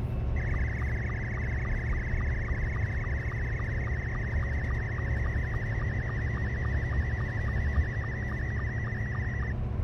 SSTV (slow-scan television), Scottie S2, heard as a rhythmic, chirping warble, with the noise inside a car.